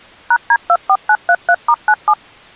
DTMF, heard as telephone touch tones, dialled by machine, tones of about 60 ms. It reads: #D24933*97